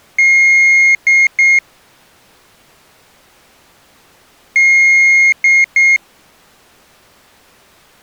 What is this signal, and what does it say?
Beep code, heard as a piezo beeper, played twice, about 2150 Hz. 1 long, 2 short. In Award, IBM and AMI BIOS tables: video adapter failure.